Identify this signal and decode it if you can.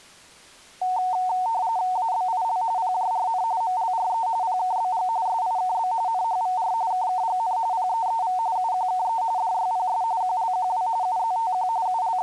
RTTY (45.45 baud, 170 Hz shift), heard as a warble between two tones, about 820 Hz centre. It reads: ABIL PJRN MLRE PKBG SIKB NHVR KKGN PEEV UQKE DYPS QLQW UZTQ …